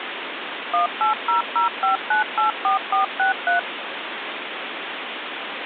DTMF, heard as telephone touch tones, dialled by machine, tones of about 130 ms, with phone line noise. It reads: 18005984463